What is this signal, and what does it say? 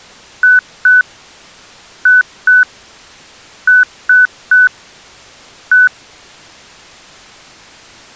Beep code, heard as beeps, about 1500 Hz. 2-2-3-1. In Phoenix BIOS tables: unexpected interrupt.